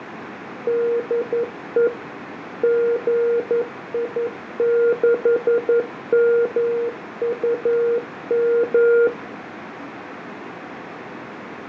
Morse code, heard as a keyed tone, machine-sent, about 11 wpm, 470 Hz, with radio static, fading, a narrow filter and room echo. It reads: DE GI6MUM